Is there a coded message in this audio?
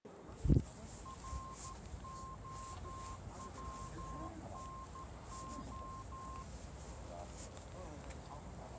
Yes: Morse code (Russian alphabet) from 1.0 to 6.5 s, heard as a keyed tone, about 13 wpm, 1060 Hz, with the noise of a residential street. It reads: РОВНО